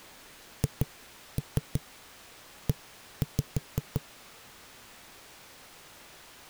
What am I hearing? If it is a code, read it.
Tap code, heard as knocks on a wall, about 5 knocks a second. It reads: HE